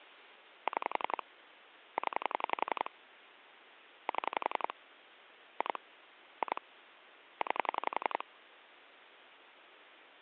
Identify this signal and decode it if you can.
Pulse dialling, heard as clicks on a phone line, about 11 pulses a second, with phone line noise. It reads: 6 0 7 2 2 9